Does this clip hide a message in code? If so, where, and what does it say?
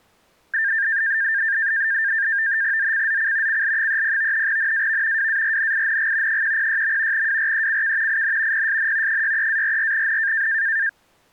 Yes: NAVTEX (SITOR-B), 100 baud, 170 Hz shift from 0.5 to 10.9 s, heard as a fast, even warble, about 1700 Hz centre. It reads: ZCZC CL30 NAV WARNING 106. WRECK IN PSN 63-44N